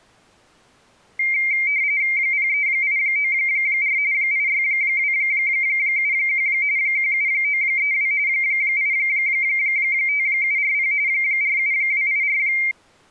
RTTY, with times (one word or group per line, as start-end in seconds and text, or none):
2.2-4.0 03894
4.1-6.5 86271
6.8-8.1 17932
8.3-10.9 85740
11.1-12.4 47284